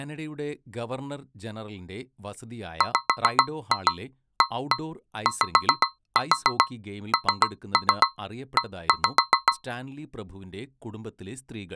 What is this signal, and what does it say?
Tap code, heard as taps on a metal pipe, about 7 knocks a second, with speech in Malayalam. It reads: WAYNE